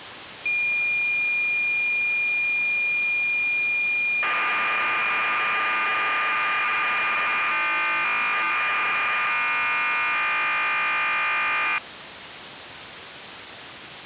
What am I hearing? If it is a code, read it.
Cassette data (Kansas City type), 1200 baud, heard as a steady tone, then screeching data, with tape hiss.